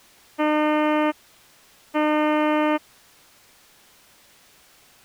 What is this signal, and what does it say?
Ship horn signal, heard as a ship's horn, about 300 Hz. 2 short. At sea: I am altering course to port.